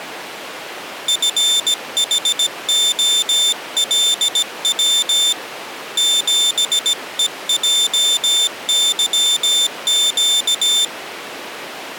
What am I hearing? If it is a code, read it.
Morse code, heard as a high beeper, hand-sent with a paddle, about 17 wpm, 3550 Hz. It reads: FHOLW 7EJYQ